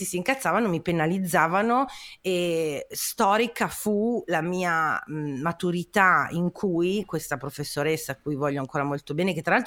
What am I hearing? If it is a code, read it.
Speech in Italian. There is no code.